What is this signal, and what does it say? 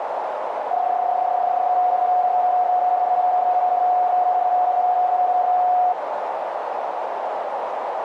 PSK31 (31.25 baud), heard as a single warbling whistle, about 730 Hz, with radio static and a narrow filter.